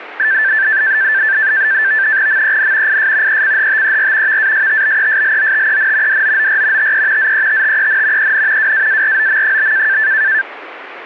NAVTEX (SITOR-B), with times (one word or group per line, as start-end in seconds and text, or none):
2.3-3.0 MEN
2.9-3.4 IS
3.3-4.4 ECHTER
4.3-6.2 VASTBESLOTEN
6.1-6.9 DOOR
6.8-7.3 TE
7.2-8.3 ZETTEN
8.2-8.7 EN
8.6-10.0 WAAROM?